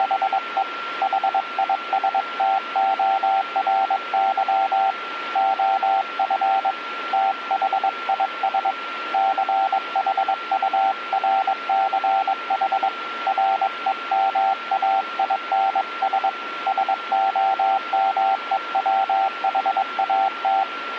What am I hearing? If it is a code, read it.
Morse code, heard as a keyed tone, hand-sent with a paddle, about 22 wpm, 780 Hz, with radio static and a steady whistle near 1370 Hz. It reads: … HISTORY OF THIS CHURCH REMAINS SOMEWHAT